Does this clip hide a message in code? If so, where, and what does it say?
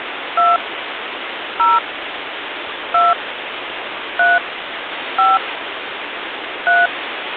Yes: DTMF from 0.4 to 6.9 s, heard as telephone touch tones, dialled by hand, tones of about 190 ms, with phone line noise. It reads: 2 0 2 3 5 3